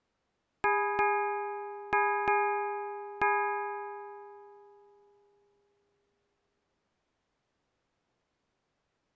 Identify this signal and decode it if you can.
Ship's bell, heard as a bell. 5. Five half-hours of the watch have passed.